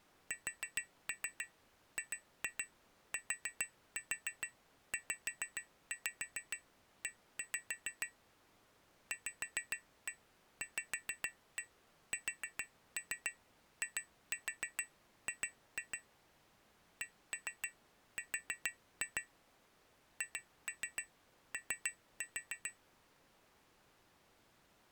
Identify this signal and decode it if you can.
Tap code, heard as taps on glass, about 6 knocks a second. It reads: SGTZE VVSIG CR HO